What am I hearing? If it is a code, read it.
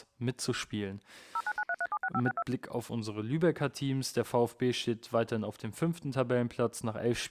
DTMF, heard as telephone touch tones, dialled by machine, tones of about 50 ms, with speech in German. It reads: 0993376562